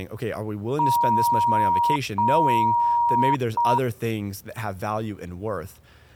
Beep code, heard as beeps, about 950 Hz, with speech in English. 2 long, 1 short.